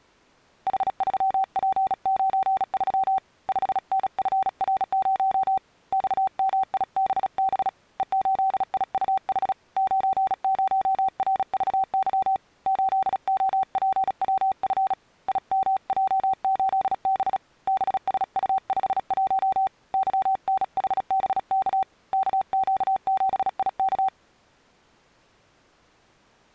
Morse code, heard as a keyed tone, hand-sent with a bug key, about 36 wpm, 770 Hz. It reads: H3P93 5NFR0 XMIBB E8IUH 90RVY 8OPWF IMJ8B BSU51 YNHBK KQ7IK